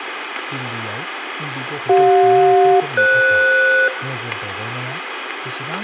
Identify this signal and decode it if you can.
Aircraft SELCAL, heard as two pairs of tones, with radio static, room echo and speech in Bodo. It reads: CJ-FS